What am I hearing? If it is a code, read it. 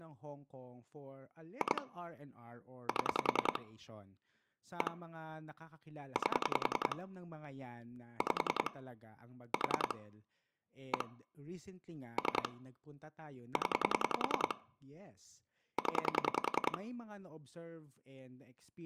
Pulse dialling, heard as clicks on a phone line, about 10 pulses a second, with speech in Filipino. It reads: 2 7 1 8 5 4 1 3 0 0